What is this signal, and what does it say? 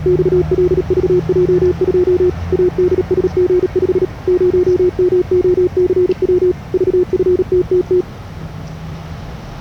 Morse code, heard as a keyed tone, machine-sent, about 37 wpm, 360 Hz, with the noise of a residential street. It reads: XLVJ2 ADSG5 0MOCW VFTTT